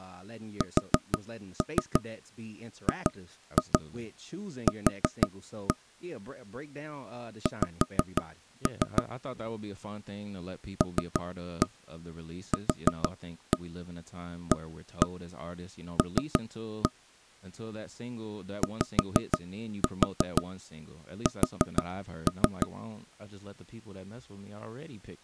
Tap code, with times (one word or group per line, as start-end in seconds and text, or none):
0.6-5.7 SGQ
7.5-9.0 X
10.8-16.9 LQAL
18.6-22.7 YS